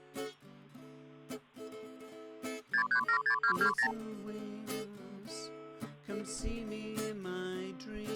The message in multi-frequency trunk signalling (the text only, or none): 6376220